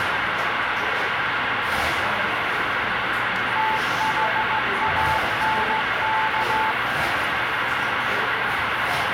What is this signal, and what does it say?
Morse code, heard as a keyed tone, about 16 wpm, 880 Hz, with heavy radio static and the noise of a cafe. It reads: THANK